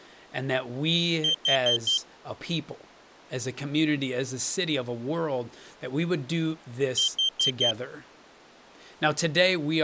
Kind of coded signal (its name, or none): alarm pattern